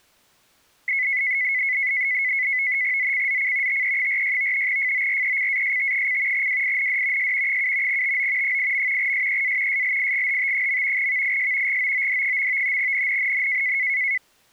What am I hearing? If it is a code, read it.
NAVTEX (SITOR-B), 100 baud, 170 Hz shift, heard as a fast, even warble, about 2100 Hz centre. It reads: ZCZC TE46 FORECAST: WIND S 7 TO 8. SEA SLIGHT. VIS GOOD. NNNN